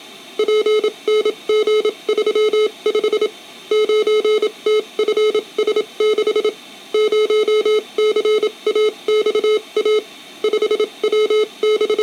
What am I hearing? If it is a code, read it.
Morse code, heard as electronic beeps, machine-sent, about 27 wpm, spaced as for 23 wpm, 430 Hz. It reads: PNG35 9TFS6 0CAXA …